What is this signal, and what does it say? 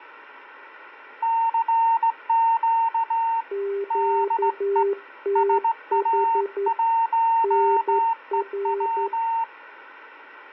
Morse code, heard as two keyed tones, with radio static. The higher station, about 17 wpm, 910 Hz: CQ DE SA1EW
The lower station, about 11 wpm, 400 Hz: QTH NR